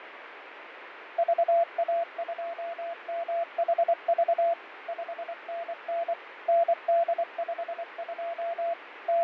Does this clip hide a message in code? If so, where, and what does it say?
Yes: Morse code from 1.1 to 9.2 s, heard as a keyed tone, machine-sent, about 24 wpm, 680 Hz, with radio static and fading. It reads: VA2MHV 5NN ND52 …